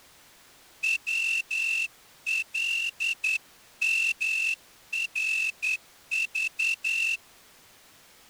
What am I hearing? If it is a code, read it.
Morse code, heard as a whistle, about 10 wpm. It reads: WLMRV